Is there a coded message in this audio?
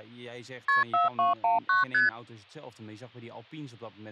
Yes: multi-frequency trunk signalling (R1, as on North American trunks) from 0.7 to 2.1 s, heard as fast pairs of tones, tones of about 150 ms, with speech in Dutch. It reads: KP 4219 ST